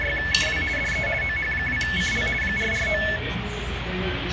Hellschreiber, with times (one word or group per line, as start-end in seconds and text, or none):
none